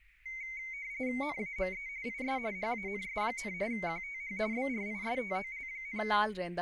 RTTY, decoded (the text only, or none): NAME IS HANS, QTH BRISTOL,